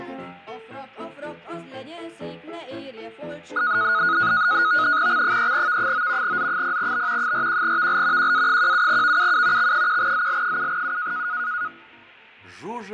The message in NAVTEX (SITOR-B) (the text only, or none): X3V9 Z0B 41VL QA17VUU X1ZL7U